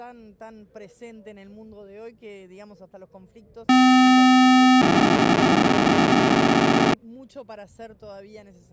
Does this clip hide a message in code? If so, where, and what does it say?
Yes: POCSAG pager data (512 baud) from 3.7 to 6.9 s, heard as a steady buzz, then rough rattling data.